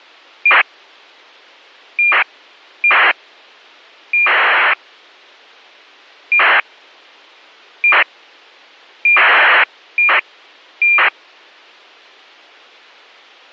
ACARS aircraft data, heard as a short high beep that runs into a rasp, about 2400 baud.